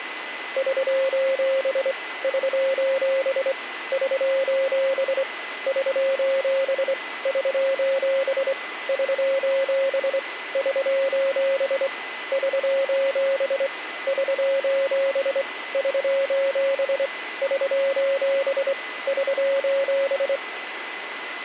Morse code, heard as a keyed tone, hand-sent with a straight key, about 24 wpm, 540 Hz, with radio static and a steady whistle near 2010 Hz. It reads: <SOS> <SOS> <SOS> <SOS> <SOS> <SOS> <SOS> <SOS> <SOS> <SOS> <SOS> <SOS>